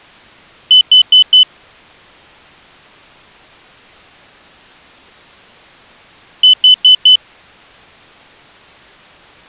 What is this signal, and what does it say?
Alarm pattern, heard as an alarm's beeps, played twice, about 3000 Hz. Temporal four. Carbon monoxide.